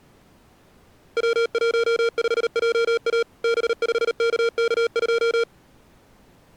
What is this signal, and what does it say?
Morse code, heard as electronic beeps, machine-sent, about 38 wpm, 460 Hz. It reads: W15JA B5KK2